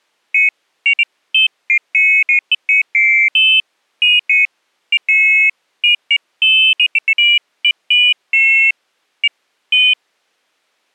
Pairs of high tones at irregular times. There is no code.